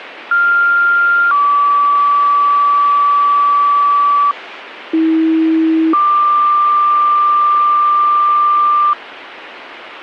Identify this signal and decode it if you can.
Two-tone page, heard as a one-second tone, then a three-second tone, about 1400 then 1150 Hz, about 320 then 1180 Hz, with radio hiss.